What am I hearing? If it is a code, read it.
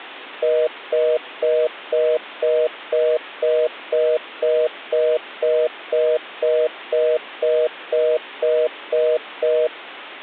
Telephone call progress tone (North American plan), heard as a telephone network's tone, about 480, 620 Hz, 0.25 s on and 0.25 s off. Congestion tone.